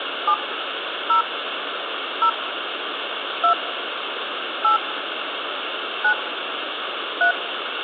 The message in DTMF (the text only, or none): 7 0 0 2 8 9 3